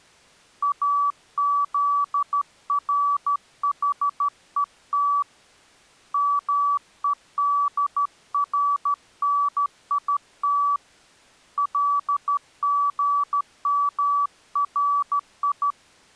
Morse code (Hebrew alphabet), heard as a keyed tone, hand-sent with a straight key, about 13 wpm, 1150 Hz. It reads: אזרחות מודרנית לגמרי